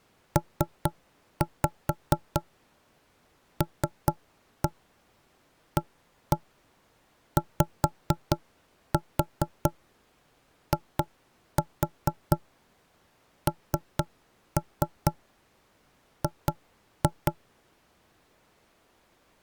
Tap code, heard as knocks on wood, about 4 knocks a second. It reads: PLAYING